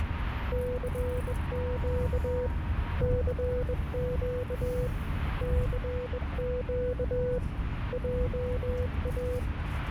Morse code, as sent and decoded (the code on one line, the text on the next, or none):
-.-. --.- / -.-. --.- / -.-. --.- / .--- .-
CQ CQ CQ JA